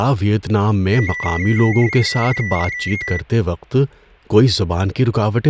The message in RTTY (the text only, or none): DIE